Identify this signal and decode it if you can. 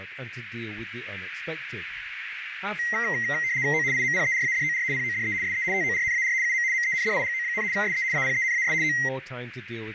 RTTY (75 baud, 170 Hz shift), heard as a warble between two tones, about 2000 Hz centre, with radio static, a narrow filter and speech in English. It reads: O IMPERADOR PODE SE TORNAR UM MENDIGO, SE APENAS O